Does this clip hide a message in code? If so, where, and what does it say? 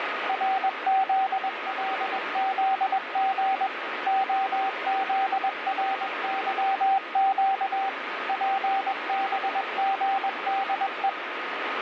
Yes: Morse code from 0.2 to 11.2 s, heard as a keyed tone, machine-sent, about 21 wpm, 780 Hz, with radio static. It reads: RZLZG OZRYQ PBGDE